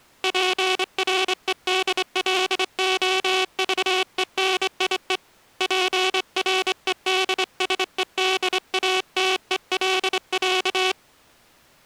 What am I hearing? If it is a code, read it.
Morse code (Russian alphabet), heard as a buzzer, hand-sent with a straight key, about 25 wpm. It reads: ПРЕДЛОЖЕНИЕ ПРЕДСЕДАТЕЛЯ